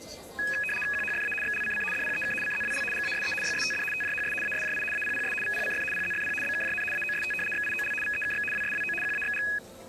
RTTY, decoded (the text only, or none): QHFA XLCC DPEK CZWL GASE YSTD TJHS ASJI APPS VPCF PZFP BKJN AOST XIOL VEKX WSWO QAXG